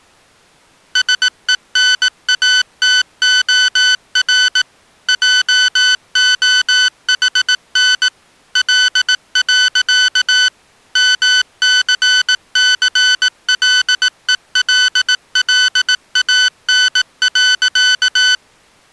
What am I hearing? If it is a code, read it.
Morse code, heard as electronic beeps, machine-sent, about 18 wpm, 1500 Hz. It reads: SENATOR JOHN L. MCCLELLAN.